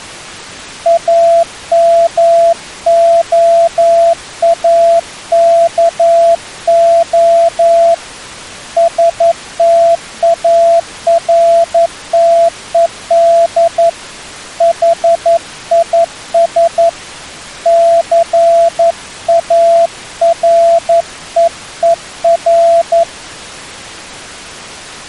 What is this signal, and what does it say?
Morse code, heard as a keyed tone, hand-sent with a paddle, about 11 wpm, 670 Hz. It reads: AMOAKO STARTED HIS CAREER